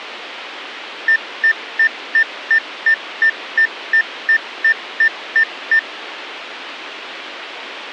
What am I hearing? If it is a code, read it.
Evenly repeated beeps. There is no code.